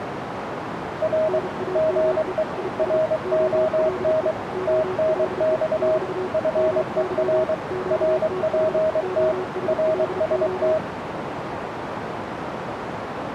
Morse code, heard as two keyed tones, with radio static and a narrow filter. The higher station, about 23 wpm, 630 Hz: R GE RON TNX FER RPT RST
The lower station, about 34 wpm, 370 Hz: NAME IS OLE OLE <BT> MY QTH OSLO